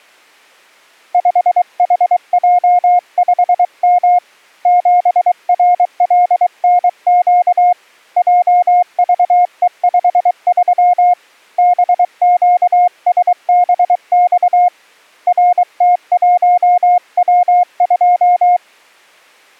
Morse code, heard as a keyed tone, hand-sent with a paddle, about 23 wpm, 710 Hz. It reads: 5HJ5M 7RLNQ JVE53 BQSBX RT1W2